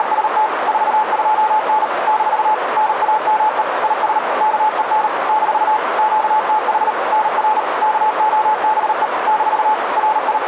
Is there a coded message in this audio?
Yes: Morse code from 0.0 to 10.5 s, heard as a keyed tone, machine-sent, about 38 wpm, 860 Hz, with radio static and a narrow filter. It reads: … 42N - NAME IS KEN - QTH NR KOBE - …